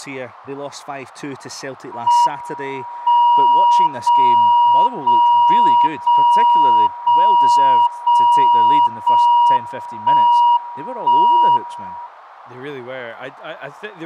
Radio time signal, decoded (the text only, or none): M 0 0 0 0 0 0 1 1 1